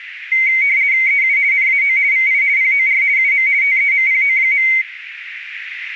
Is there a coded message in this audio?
Yes: RTTY (50 baud, 170 Hz shift) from 0.3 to 4.8 s, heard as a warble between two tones, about 2150 Hz centre, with radio static. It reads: EU NAO VI POR UM TEMPO.